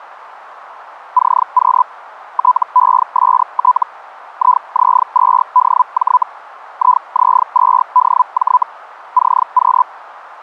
Hellschreiber (Feld-Hell, 122.5 baud), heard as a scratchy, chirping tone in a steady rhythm, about 1000 Hz. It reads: CQ TEST IZ2DJ IZ2DJ CQ